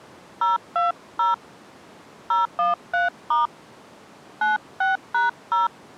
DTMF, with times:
0.4-1.3 020
2.3-3.5 013*
4.4-5.7 96#0

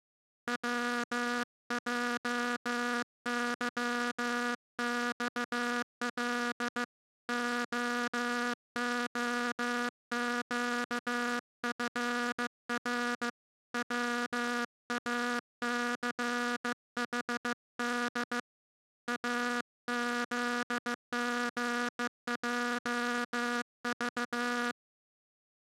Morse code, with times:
0.5-6.8 WJYXL
7.3-13.3 OOQFR
13.7-18.4 WACHD
19.1-24.7 AZGJV

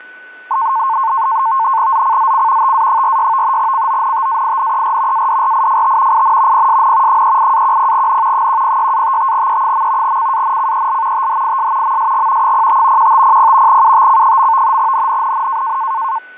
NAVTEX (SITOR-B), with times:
1.9-2.7 ZCZC
2.6-3.6 TA46
3.6-5.3 CONTAINER
5.1-6.2 ADRIFT
6.1-6.7 IN
6.5-7.2 PSN
7.1-8.5 38-10N
8.3-10.2 106-55E.
10.0-11.3 CANCEL
11.1-12.0 THIS
11.8-12.5 MSG
12.4-13.1 05
13.0-13.8 1500
13.7-14.8 UTC.
14.8-15.8 NNNN

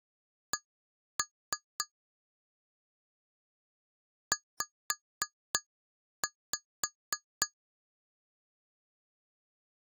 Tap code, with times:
0.5-1.8 C
4.3-7.5 Z

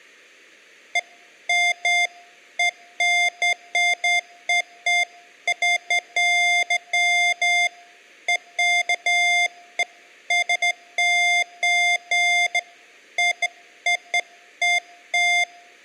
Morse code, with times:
none

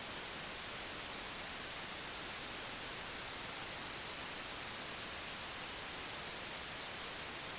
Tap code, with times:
none

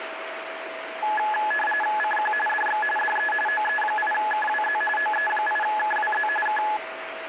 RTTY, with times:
2.0-2.3 CQ
2.5-2.8 DX
3.0-3.3 DE
3.5-4.8 OE8KWZ
5.0-6.3 OE8KWZ
6.5-6.6 K

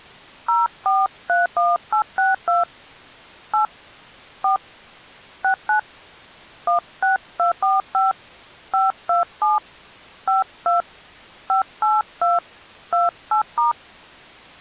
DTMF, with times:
0.5-2.6 0431862
3.5-3.6 8
4.4-4.6 4
5.4-5.8 69
6.7-8.1 16245
8.7-9.6 527
10.3-10.8 52
11.5-12.4 582
12.9-13.7 28*

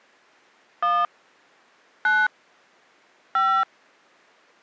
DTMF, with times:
0.8-1.0 1
2.1-2.3 9
3.4-3.6 5

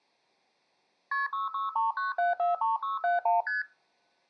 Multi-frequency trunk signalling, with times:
1.1-1.3 KP
1.3-3.4 6639743671
3.5-3.6 ST

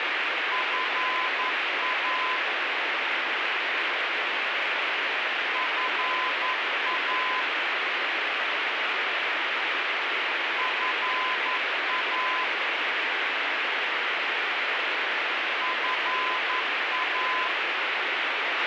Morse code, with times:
0.5-2.4 FA
5.6-7.4 FA
10.6-12.4 FA
15.6-17.5 FA

